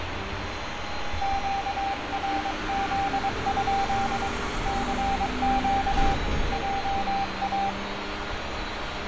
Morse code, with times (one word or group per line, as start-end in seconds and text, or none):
1.2-4.3 QRZ?
4.7-6.1 CQ
6.5-7.7 JA